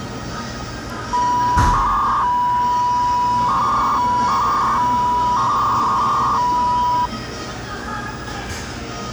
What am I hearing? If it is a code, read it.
300-baud modem data (V.21 tones), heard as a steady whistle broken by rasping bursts, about 300 baud, 200 Hz shift, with the noise of a cafe.